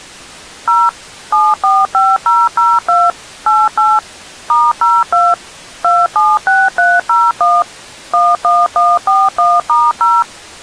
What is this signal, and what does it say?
DTMF, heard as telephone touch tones, dialled by machine, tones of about 220 ms. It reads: 0 745002 88 *02 276301 11141*0